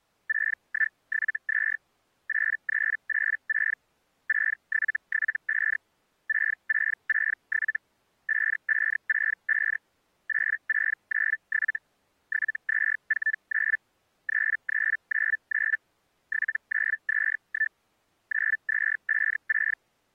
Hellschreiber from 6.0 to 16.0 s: 6667 5565 8697 7249 3399

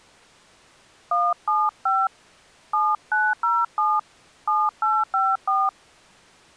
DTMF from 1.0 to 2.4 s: 175

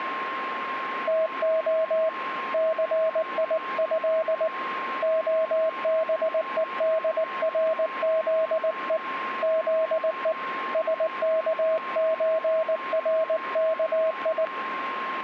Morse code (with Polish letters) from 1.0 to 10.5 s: TO CIĘ OBEDRZE ZE

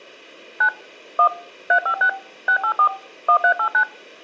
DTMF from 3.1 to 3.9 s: 1389

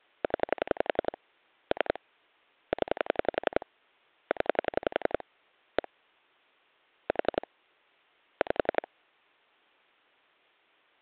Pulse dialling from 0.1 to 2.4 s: 0 3

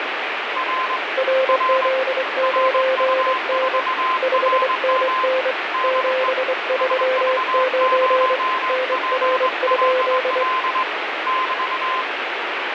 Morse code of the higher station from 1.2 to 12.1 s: R RU4RM DE SV0PLL <BT>

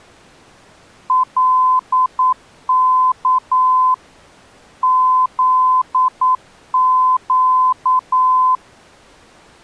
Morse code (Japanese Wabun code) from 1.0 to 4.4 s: カワ

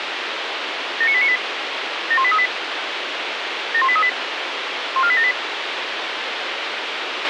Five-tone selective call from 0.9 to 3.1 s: 79898 71838

